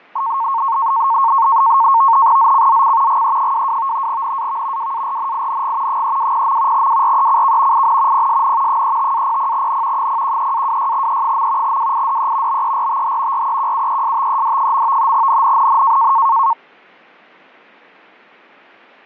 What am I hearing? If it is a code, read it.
NAVTEX (SITOR-B), 100 baud, 170 Hz shift, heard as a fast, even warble, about 1000 Hz centre, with fading. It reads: ZCZC GE22 NAV WARNING 320. WRECK IN PSN 35-00N 013-26E. WIDE BERTH REQUESTED. NNNN